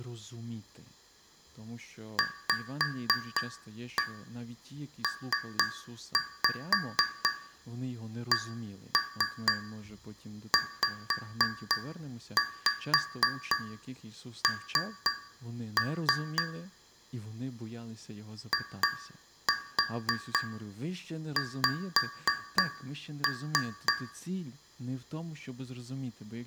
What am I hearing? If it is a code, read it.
Tap code, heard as taps on a metal pipe, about 3 knocks a second, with room echo and speech in Ukrainian. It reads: VPCZN IX